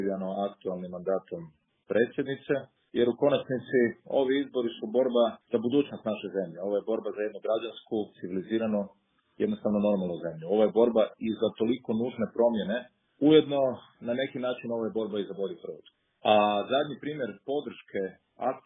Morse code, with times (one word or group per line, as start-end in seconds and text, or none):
none